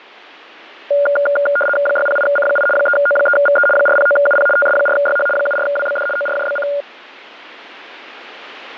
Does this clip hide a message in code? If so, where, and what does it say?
Yes: RTTY (75 baud, 850 Hz shift) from 0.9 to 6.8 s, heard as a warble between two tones, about 1000 Hz centre. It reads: 608C8 3O3VE 409UP TS4YH 74WBD ORJBC